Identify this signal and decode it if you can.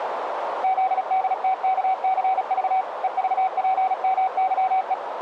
Morse code, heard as a keyed tone, machine-sent, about 36 wpm, 760 Hz, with radio static and a narrow filter. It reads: ZDTKCV EVPMYE